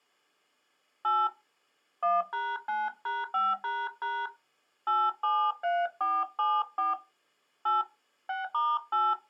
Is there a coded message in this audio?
Yes: DTMF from 1.0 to 9.1 s, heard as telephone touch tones, dialled by hand, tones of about 220 ms. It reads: 8 1#9#5## 873474 8 6*8